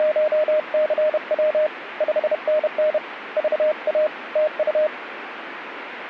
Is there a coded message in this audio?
Yes: Morse code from 0.0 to 4.9 s, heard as a keyed tone, hand-sent with a paddle, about 31 wpm, 610 Hz, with radio static. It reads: … 5NN VA TU